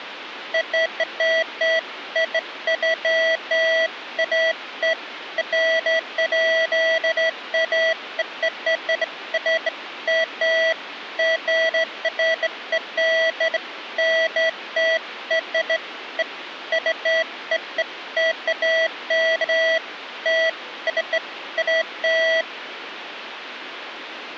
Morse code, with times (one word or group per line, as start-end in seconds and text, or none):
none